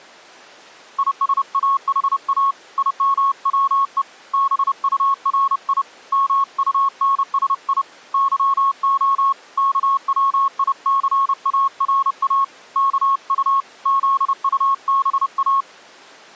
Morse code, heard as a keyed tone, hand-sent with a paddle, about 30 wpm, 1100 Hz. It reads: ISAHA IMWE BURI MUNSI YO KWICARA KU ZUBA